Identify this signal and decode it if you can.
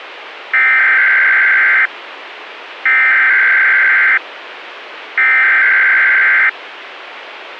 Emergency Alert System (SAME) tones (header bursts), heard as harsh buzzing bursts, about 520.83 baud, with radio hiss.